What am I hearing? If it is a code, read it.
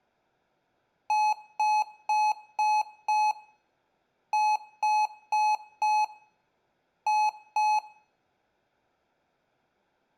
Beep code, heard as beeps from a small speaker, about 850 Hz, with room echo. 5-4-2.